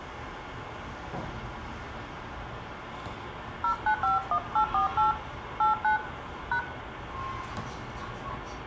DTMF, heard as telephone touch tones, dialled by hand, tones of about 110 ms, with phone line noise, room echo and the noise inside a lift. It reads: 0951848 89 #